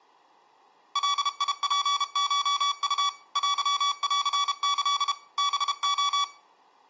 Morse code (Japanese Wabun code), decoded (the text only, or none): ガツコウ テンキ ハレ